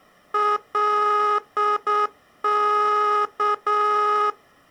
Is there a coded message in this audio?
Yes: Morse code (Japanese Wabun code) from 0.3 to 4.4 s, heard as a buzzer, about 7 wpm. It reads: カワ